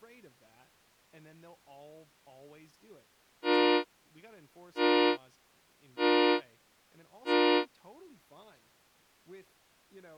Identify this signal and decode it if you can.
Train horn signal, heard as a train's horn, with speech in English. 4 short. On North American railways: a request for a signal to be given or repeated.